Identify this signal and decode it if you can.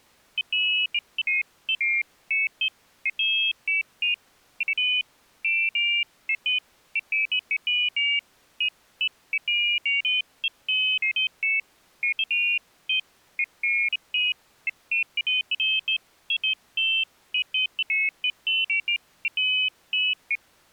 Pairs of high tones at irregular times. There is no code.